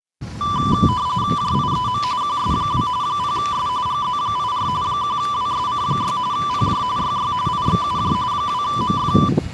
RTTY (45.45 baud, 170 Hz shift), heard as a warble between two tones, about 1080 Hz centre, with the noise of a residential street. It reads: JIEM QS2 0S GZ84 1WSC6 PJ YY IXUJ 2MF